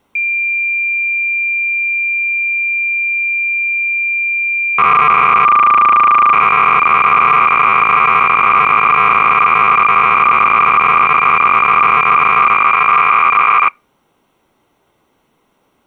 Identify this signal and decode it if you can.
Cassette data (Kansas City type), 300 baud, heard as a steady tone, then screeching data.